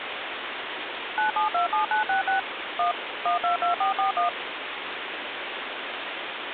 DTMF, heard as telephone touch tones, dialled by machine, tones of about 120 ms, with phone line noise. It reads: 9727966 1 122441